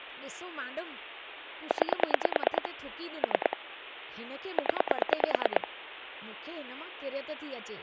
Pulse dialling, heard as clicks on a phone line, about 9 pulses a second, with speech in Sindhi. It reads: 9 3 0